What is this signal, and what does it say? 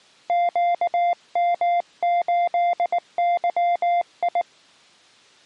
Morse code, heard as a keyed tone, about 19 wpm, 700 Hz. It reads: QM8YI